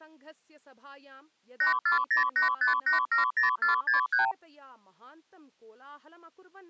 Multi-frequency trunk signalling (R2, with the far end's replies), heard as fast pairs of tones, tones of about 130 ms, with speech in Sanskrit. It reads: 84085870463